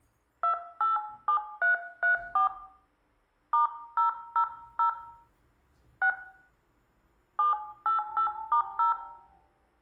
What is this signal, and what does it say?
DTMF, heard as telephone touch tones, dialled by hand, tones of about 120 ms, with room echo and the noise inside a lift. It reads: 287334 *000 6 788*0